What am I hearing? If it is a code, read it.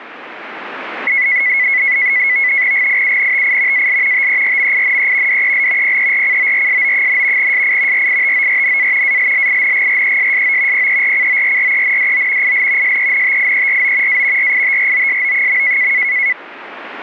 NAVTEX (SITOR-B), 100 baud, 170 Hz shift, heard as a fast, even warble, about 2100 Hz centre. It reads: GIUNTI AL TERMINE DEL PERCORSO, SI RITORNA ALLINGRESSO PERCORRENDO IL SENTIERO A RITROSO.